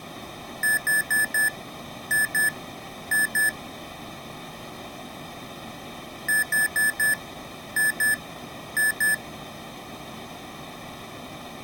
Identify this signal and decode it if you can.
Beep code, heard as beeps from a small speaker, played twice, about 1750 Hz. 4-2-2. In Phoenix BIOS tables: shutdown test failure.